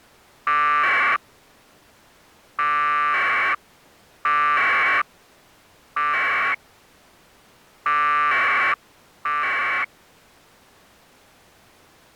Packet radio (AX.25, as in APRS), 1200 baud, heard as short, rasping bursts.